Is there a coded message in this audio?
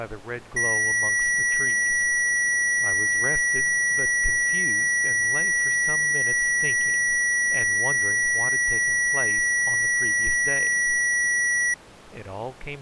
No, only a steady tone.